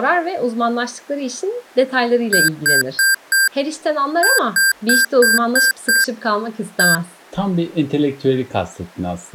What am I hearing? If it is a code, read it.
Beep code, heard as beeps from a small speaker, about 1600 Hz, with speech in Turkish. 4-6-1.